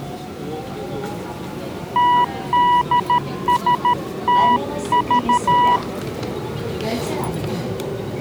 Morse code, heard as a keyed tone, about 13 wpm, 980 Hz, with the noise inside a subway train. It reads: TDSTV